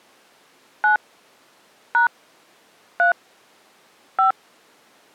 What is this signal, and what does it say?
DTMF, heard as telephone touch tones, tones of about 120 ms. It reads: 9 # 3 5